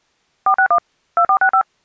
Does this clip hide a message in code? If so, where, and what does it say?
Yes: DTMF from 0.5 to 1.6 s, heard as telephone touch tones, dialled by machine, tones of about 80 ms. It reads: 461 2465